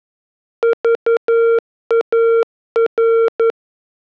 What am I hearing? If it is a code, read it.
Morse code, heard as a keyed tone, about 11 wpm, 460 Hz. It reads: VAR